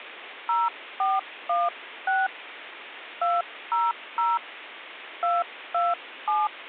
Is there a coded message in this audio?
Yes: DTMF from 0.5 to 6.5 s, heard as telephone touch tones, dialled by hand, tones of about 200 ms, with phone line noise. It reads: 0416 200 227